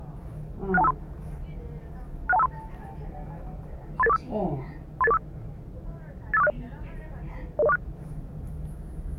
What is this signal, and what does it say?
Five-tone selective call (EIA), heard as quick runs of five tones, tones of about 30 ms, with the noise inside a lift. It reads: 61253 61253 38845 38845 85460 00046